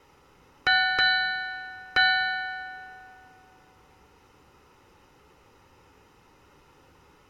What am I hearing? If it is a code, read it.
Ship's bell, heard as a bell, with room echo. 3. Three half-hours of the watch have passed.